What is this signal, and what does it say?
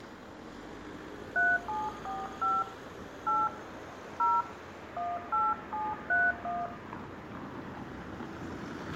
DTMF, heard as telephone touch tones, dialled by hand, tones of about 210 ms, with room echo and street noise. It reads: 3745 8 0 18731